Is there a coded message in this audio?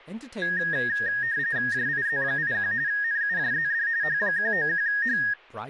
Yes: RTTY (45.45 baud, 170 Hz shift) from 0.4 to 5.3 s, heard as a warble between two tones, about 1750 Hz centre, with speech in English. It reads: JIZ81 NUJZD H191H